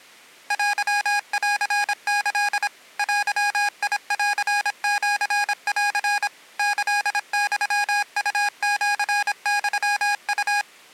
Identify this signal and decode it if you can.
Morse code (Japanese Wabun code), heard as electronic beeps, machine-sent, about 26 wpm, 820 Hz. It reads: テンキ デンシン キユウシユウ